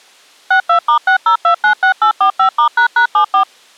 DTMF, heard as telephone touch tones, dialled by machine, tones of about 100 ms. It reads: 62*60296845*##74